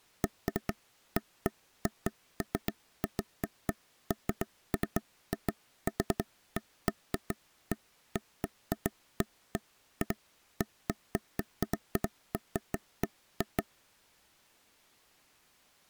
Irregular taps on a table. There is no code.